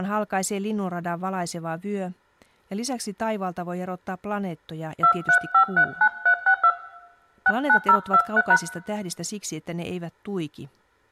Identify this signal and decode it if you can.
DTMF, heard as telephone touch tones, dialled by hand, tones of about 70 ms, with room echo and speech in Finnish. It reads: 23539362 69023#